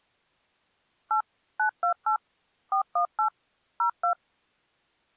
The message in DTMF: 8 928 418 02

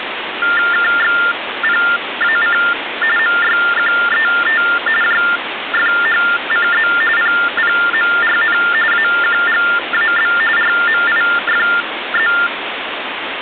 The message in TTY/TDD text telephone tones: KXPAC MYQET JFHCZ PPMRN AQGAB RMIFZ

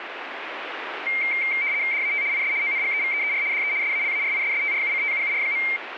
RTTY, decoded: DAT IS ONGEVEER DE SALARISSTRUCTUUR.

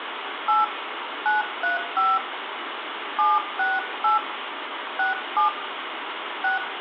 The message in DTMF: 8 935 768 67 6

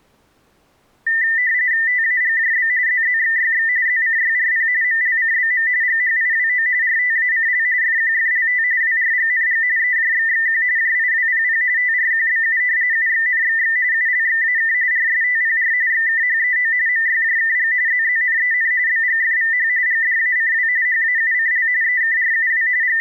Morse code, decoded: none

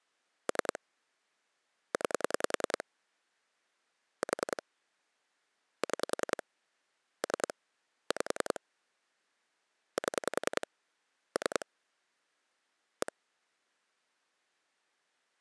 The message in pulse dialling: 3 9 4 6 3 5 7 3 1

